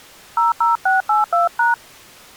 DTMF, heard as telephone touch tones, dialled by hand, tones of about 150 ms. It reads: 00682#